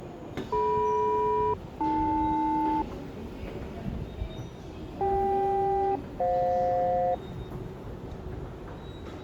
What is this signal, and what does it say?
Aircraft SELCAL, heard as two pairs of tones, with the noise of a subway station. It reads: DM-AL CK-FJ